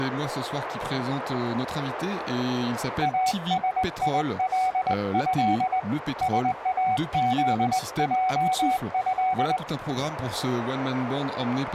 Morse code (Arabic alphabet), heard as a keyed tone, hand-sent with a straight key, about 20 wpm, 750 Hz, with radio static and a narrow filter. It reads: اسيله ساذجه